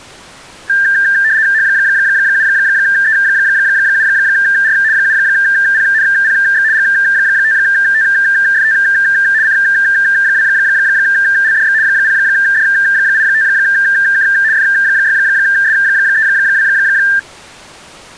RTTY (75 baud, 170 Hz shift), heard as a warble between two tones, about 1700 Hz centre. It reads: H7E7R 7PNPX G5TFT C2LDX 0D85K F6S32